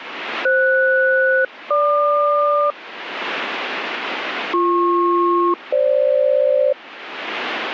Aircraft SELCAL, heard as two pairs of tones. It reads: FS-GQ BP-FG